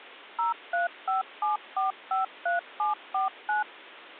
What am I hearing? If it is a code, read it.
DTMF, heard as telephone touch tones, dialled by machine, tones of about 140 ms. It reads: 0357453749